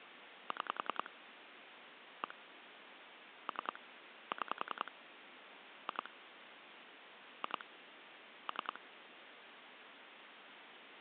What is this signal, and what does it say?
Pulse dialling, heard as clicks on a phone line, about 10 pulses a second, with phone line noise. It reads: 6 1 3 6 2 2 3